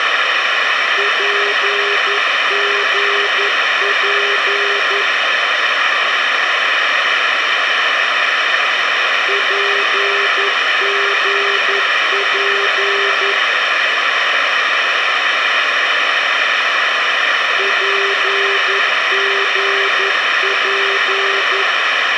Morse code, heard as a keyed tone, machine-sent, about 11 wpm, 400 Hz, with radio hiss. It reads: PGP PGP PGP